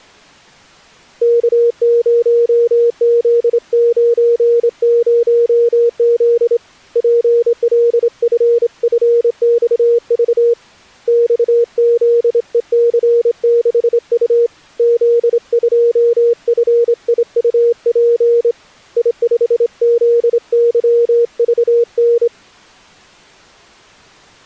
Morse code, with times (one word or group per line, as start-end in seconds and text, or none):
1.2-6.6 K0Z90Z
7.0-10.5 PLFFXV
11.1-14.5 XZEC6U
14.8-18.5 Z2FIUP
19.0-22.3 I5ZYVN